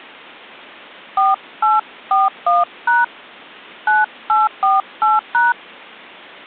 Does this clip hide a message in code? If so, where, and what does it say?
Yes: DTMF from 1.2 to 5.5 s, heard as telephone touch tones, dialled by hand, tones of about 180 ms. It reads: 4841# 9848#